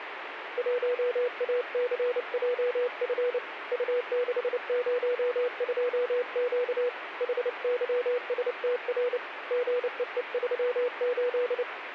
Morse code, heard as a keyed tone, hand-sent with a paddle, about 29 wpm, 490 Hz, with radio static. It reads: 1ACJF U602Q HYSTR GEE38